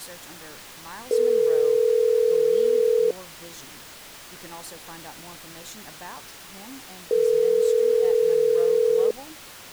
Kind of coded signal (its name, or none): telephone call progress tone